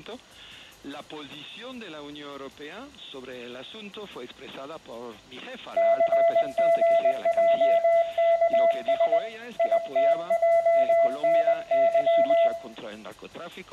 Morse code, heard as a keyed tone, hand-sent with a paddle, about 20 wpm, 670 Hz, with room echo. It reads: CGJKS ITJNY